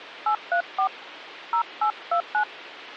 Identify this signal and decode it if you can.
DTMF, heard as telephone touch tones, dialled by hand, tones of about 90 ms. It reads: 834 0829